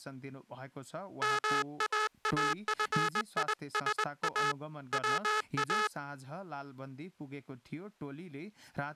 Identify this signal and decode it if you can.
Morse code, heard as a buzzer, hand-sent with a straight key, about 21 wpm. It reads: MAAFISA WA